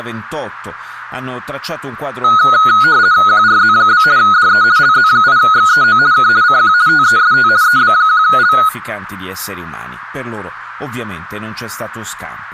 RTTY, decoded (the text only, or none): QRZ? DE LZ8XEO K CQ TEST EB1L